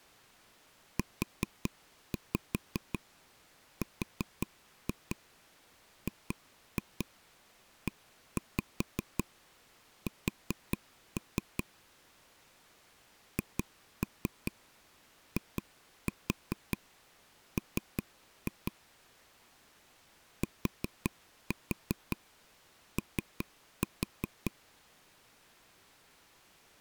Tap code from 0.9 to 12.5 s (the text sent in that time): URGES